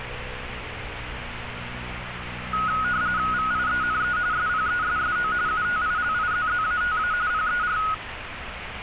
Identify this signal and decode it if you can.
RTTY (45.45 baud, 170 Hz shift), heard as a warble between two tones, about 1360 Hz centre, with radio static and street noise. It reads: VIENE SPESSO UTILIZZATA PER